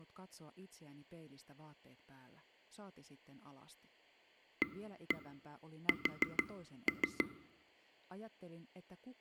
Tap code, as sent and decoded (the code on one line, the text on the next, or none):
1-1 4-3
AS